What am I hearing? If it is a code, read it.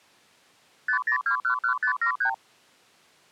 Multi-frequency trunk signalling (R2, with the far end's replies), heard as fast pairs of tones, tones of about 90 ms. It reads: 50211573